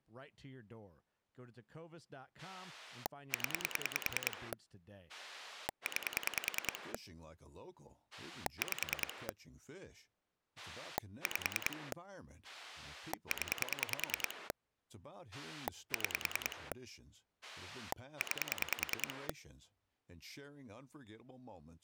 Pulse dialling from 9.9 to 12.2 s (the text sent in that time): 5